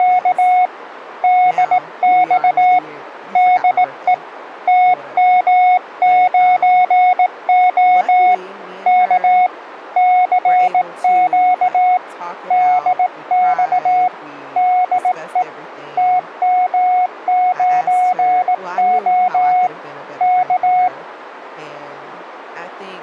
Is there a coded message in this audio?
Yes: Morse code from 0.0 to 20.9 s, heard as a keyed tone, hand-sent with a bug key, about 18 wpm, 730 Hz, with radio static and speech in English. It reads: … DX DE TM9O K CQ DX DE TM9O K